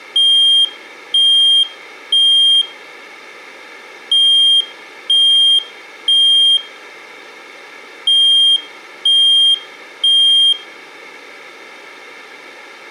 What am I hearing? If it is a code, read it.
Alarm pattern, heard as an alarm's beeps, played three times, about 3200 Hz, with room echo. Temporal three. Smoke or fire, evacuate.